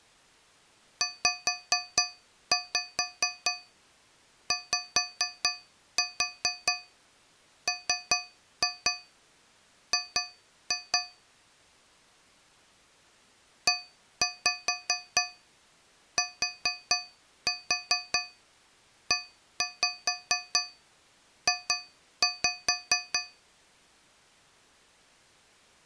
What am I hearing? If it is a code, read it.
Tap code, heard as taps on a metal pipe, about 4 knocks a second. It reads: ZYMG ETEJ